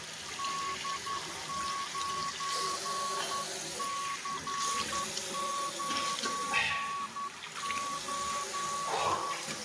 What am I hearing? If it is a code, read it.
Morse code, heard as a keyed tone, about 11 wpm, 1120 Hz, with the noise of a restroom. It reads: D9C98